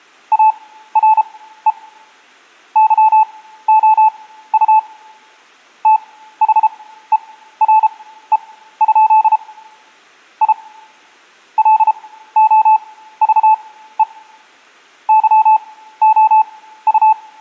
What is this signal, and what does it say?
Morse code, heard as a keyed tone, machine-sent, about 33 wpm, spaced as for 15 wpm, 870 Hz. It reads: ARE YOU THERE? I LOVE YOU